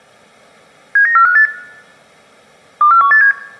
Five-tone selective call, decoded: 79458 24187

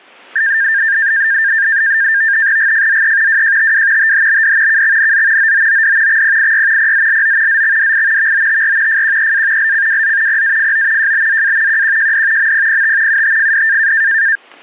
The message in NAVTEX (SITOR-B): GFZE WJTW THBD KXNZ OOOD XPIY PZLO ZXDI VOTR FQEA LCWZ PAFO JBZA QQJD MPPT UTFD

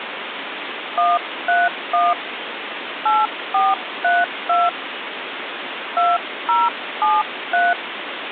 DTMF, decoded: 131 8432 2073

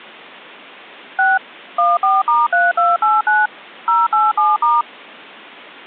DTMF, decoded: 6 14*3289 087*

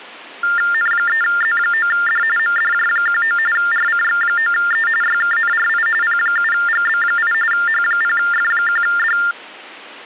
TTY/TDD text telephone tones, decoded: N3Z9D MDJ19 RCX9E YKNRI P7GB8 H0F1D

